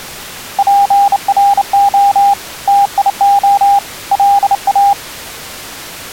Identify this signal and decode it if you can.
Morse code, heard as a keyed tone, hand-sent with a bug key, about 29 wpm, 800 Hz. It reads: PRO TIO LA